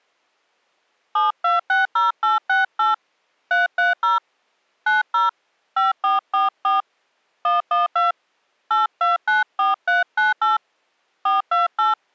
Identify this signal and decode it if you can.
DTMF, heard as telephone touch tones, dialled by hand, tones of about 160 ms. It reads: 7260868 330 90 5444 112 8294398 428